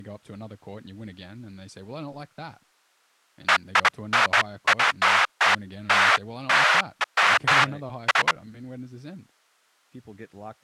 Bursts of noise, with speech in English. There is no code.